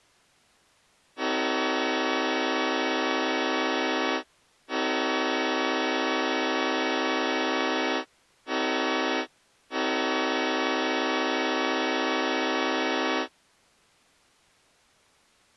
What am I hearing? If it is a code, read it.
Train horn signal, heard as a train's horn. 2 long, 1 short, 1 long. On North American railways: approaching a public crossing.